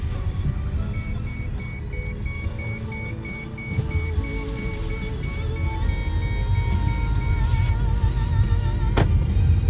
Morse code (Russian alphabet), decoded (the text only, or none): none